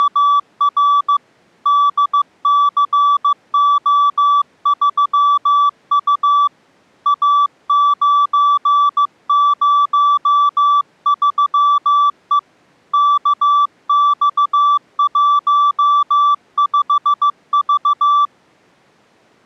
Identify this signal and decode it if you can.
Morse code, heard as a keyed tone, hand-sent with a paddle, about 15 wpm, 1160 Hz. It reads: … DCO3U A903E KX15V